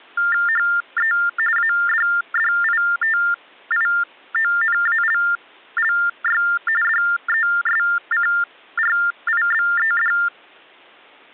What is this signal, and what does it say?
TTY/TDD text telephone tones (45.45 baud Baudot), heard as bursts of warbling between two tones, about 400 Hz shift, 1600 Hz centre. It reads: HE ADDITIONALLY DESCRIBED